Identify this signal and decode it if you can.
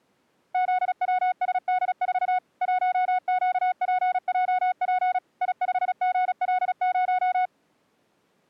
Morse code, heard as a keyed tone, machine-sent, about 36 wpm, 730 Hz. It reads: ZWSD4 1QPJP I5GL0